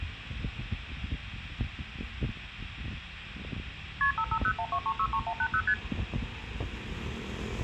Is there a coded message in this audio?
Yes: multi-frequency trunk signalling (R1, as on North American trunks) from 4.0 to 5.7 s, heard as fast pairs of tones, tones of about 70 ms, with street noise. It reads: KP 55012363180 ST